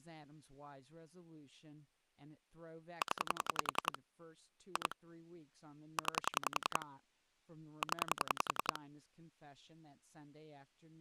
Pulse dialling, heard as clicks on a phone line, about 10 pulses a second, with speech in English. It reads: 0 2 9 0